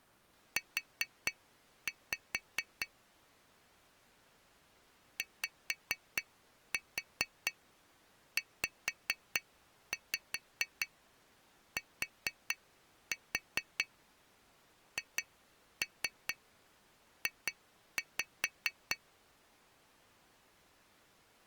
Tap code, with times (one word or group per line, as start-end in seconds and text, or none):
0.6-2.9 U
5.2-19.0 YZTHJ